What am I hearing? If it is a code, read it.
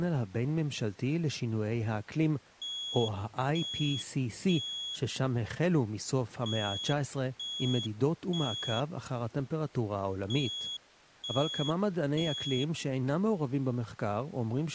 Alarm pattern, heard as an alarm's beeps, played three times, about 3350 Hz, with speech in Hebrew. Temporal three. Smoke or fire, evacuate.